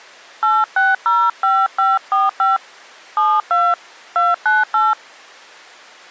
DTMF, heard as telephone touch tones, dialled by hand, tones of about 200 ms. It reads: 8605545 72 298